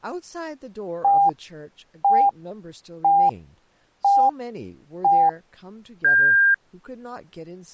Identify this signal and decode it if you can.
Radio time signal (five pips and a higher one, as on Chinese radio), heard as pips, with speech in English.